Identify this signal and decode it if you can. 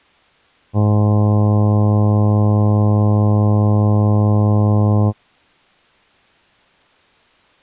Ship horn signal, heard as a ship's horn, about 100 Hz. 1 long. At sea: a vessel nearing a blind bend, or under power and making way in fog.